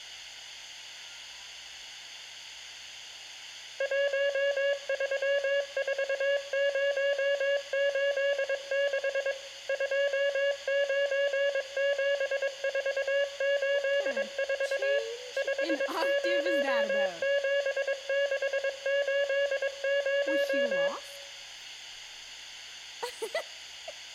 Morse code, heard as a keyed tone, machine-sent, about 22 wpm, 560 Hz, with room echo. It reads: 134086 297484 507680